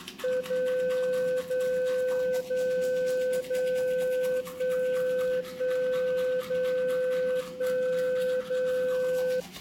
Radio time signal (DCF77), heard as a tone whose level steps once a second, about 510 Hz, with the noise of a restroom. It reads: 0 0 0 0 1 1 0 1 0